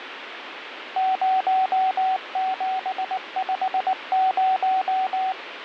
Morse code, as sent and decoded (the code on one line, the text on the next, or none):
----- --... ..... -----
0750